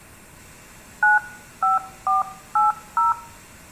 DTMF, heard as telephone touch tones, dialled by hand, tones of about 150 ms, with room echo. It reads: 95480